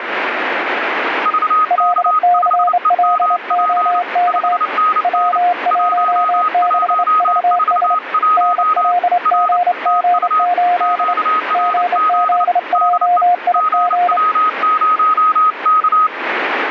Morse code, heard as two keyed tones, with radio static. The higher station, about 29 wpm, 1260 Hz: VK5EMP 5NN 1141 R TU QRZ DE GW0K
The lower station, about 28 wpm, 710 Hz: LCLOK W16VS NLGG8 GZJIG